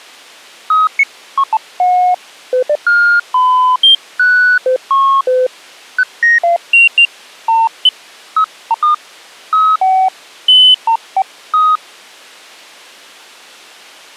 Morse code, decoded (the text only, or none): none